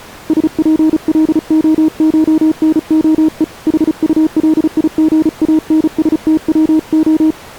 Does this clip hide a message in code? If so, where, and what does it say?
Yes: Morse code (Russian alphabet) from 0.2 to 7.4 s, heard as a keyed tone, hand-sent with a paddle, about 35 wpm, 310 Hz. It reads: СПЛОШНОЕ ХУЛИГАНСТВО